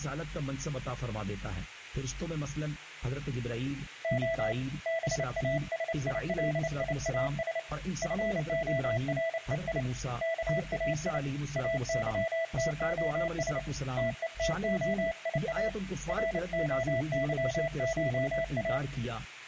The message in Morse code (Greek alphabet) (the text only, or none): Ο ΒΑΣΙΛΙΑΣ ΦΟΡΕΙ ΚΑΙ ΑΥΤΟΣ ΤΕΤΟΙΑ ΡΟΥΧΑ